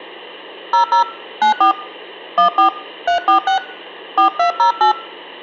DTMF, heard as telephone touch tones, dialled by hand, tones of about 110 ms, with hum. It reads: 00 94 14 346 4208